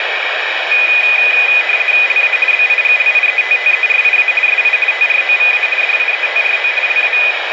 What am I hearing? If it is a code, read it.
RTTY (50 baud, 450 Hz shift), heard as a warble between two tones, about 2250 Hz centre, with radio static. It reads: LA BIGLIETTERIA SI TROVA DIETRO LA